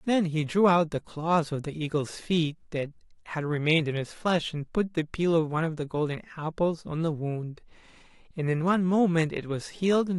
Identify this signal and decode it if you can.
Speech in English. There is no code.